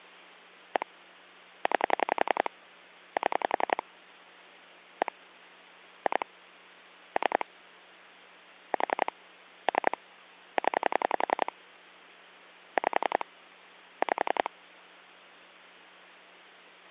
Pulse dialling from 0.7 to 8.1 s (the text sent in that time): 1 9 7 1 2 3